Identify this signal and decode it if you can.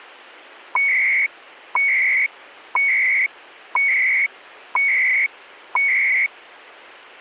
Radio time signal (CHU, Canada), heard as beeps and data bursts, one a second.